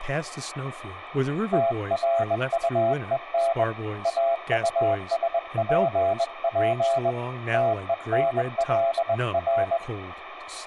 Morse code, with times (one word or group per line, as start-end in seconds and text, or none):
1.5-3.6 TRUEN
4.1-7.1 AUSPP
7.5-9.8 TENLR